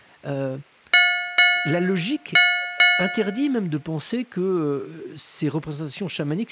Ship's bell, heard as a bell, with speech in French. 4. Four half-hours of the watch have passed.